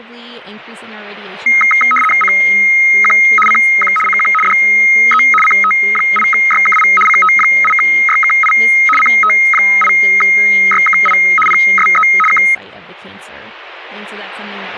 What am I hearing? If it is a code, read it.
RTTY (75 baud, 850 Hz shift), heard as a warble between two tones, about 1700 Hz centre, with speech in English. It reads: CQ CQ CQ DE CT8YKI CT8YKI CT8YKI PSE K